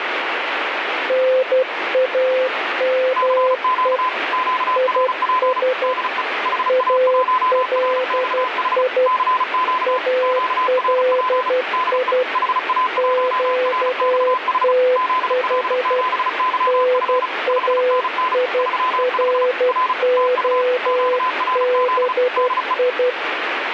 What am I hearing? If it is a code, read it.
Morse code, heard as two keyed tones, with radio static. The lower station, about 12 wpm, 510 Hz: NAME IS ALI ALI QTH NAIROBI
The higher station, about 35 wpm, 1020 Hz: CQ QRP DE HA1RXH CQ QRP DE HA1RXH ZL7YF 5NN 35 R TU QRZ DE